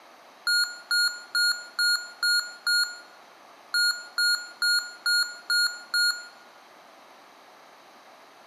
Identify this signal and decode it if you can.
Beep code, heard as beeps from a small speaker, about 1430 Hz, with room echo. 6-6.